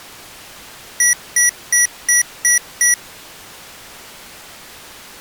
Beep code, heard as beeps from a small speaker, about 1950 Hz. 6 short. In AMI BIOS tables: keyboard controller gate A20 failure; in Dell tables: video card failure.